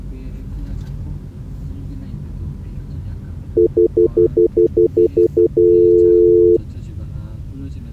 Telephone call progress tone (North American plan), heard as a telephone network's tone, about 350, 440 Hz, 0.1 s on and 0.1 s off, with the noise inside a car. Stutter dial tone.